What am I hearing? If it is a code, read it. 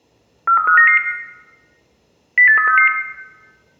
Five-tone selective call (CCIR), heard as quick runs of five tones, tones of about 100 ms, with room echo. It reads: 43599 08366